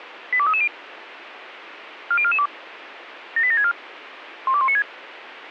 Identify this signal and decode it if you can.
Five-tone selective call (ZVEI), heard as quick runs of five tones, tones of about 70 ms, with radio hiss. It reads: 82330 40442 78764 12196